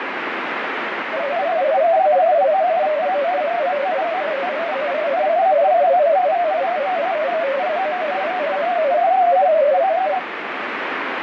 Multi-tone FSK (Olivia or MFSK type), about 250 Hz wide, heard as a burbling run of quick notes, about 31.25 baud, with radio static.